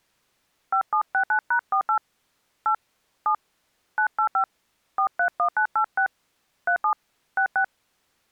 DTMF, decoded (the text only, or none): 5769#48 8 7 985 431986 37 66